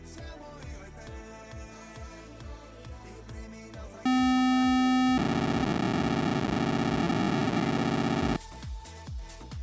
POCSAG pager data (512 baud), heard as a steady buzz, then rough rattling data.